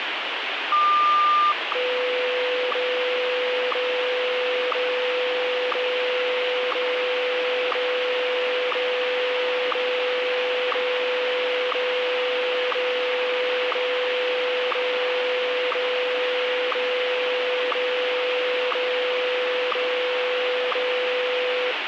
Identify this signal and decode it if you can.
Radio time signal (WWVH, Hawaii), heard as ticks, one a second, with radio static.